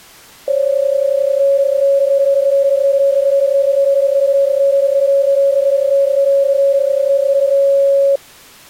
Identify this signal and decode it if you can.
PSK31 (31.25 baud), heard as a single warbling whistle, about 550 Hz.